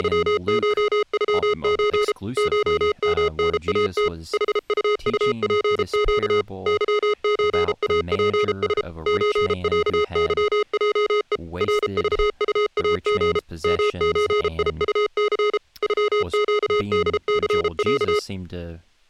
Morse code (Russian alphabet), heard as electronic beeps, machine-sent, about 33 wpm, 420 Hz, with speech in English. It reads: … ШМНАТ ХУУПЩ ЫЧАПС ЧЯЫЙЕ РЖУАГ МЧИУЦ ЮЩДЦЯ